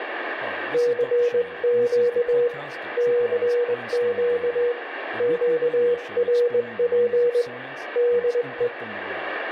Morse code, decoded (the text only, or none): CQ CQ QRP DE